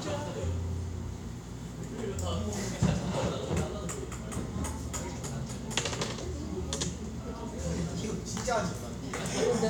The noise of a cafe. There is no code.